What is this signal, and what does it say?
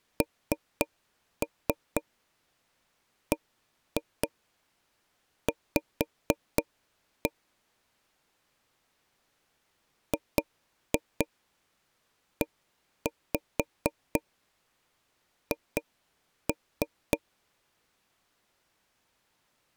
Tap code, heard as taps on a table, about 4 knocks a second. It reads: NBV GEH